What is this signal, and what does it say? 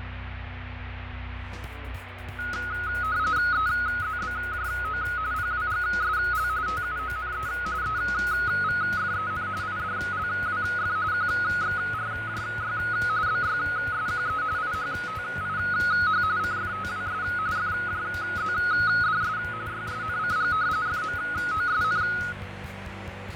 RTTY (45.45 baud, 170 Hz shift), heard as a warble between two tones, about 1360 Hz centre, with radio static and fading. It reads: EZBJO PWGSL TUONE EVFEN IDLWF QXRJY BYSQE IHTIH CFTWS FJZDS YSNCG FMOSN